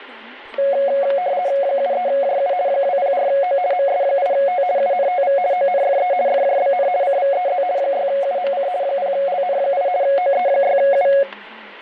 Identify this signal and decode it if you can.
RTTY (50 baud, 170 Hz shift), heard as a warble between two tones, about 640 Hz centre, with static crashes and speech in English. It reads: 73JU 204O MS8T UNTV ONFE FJBN CVEZ 6UMC 0LN8 OE6U